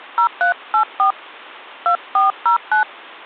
DTMF, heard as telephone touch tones, dialled by hand, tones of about 120 ms. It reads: 0384 2409